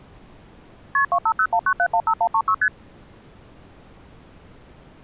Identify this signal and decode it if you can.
Multi-frequency trunk signalling (R1, as on North American trunks), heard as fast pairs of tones, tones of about 70 ms. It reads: KP 25019715136 ST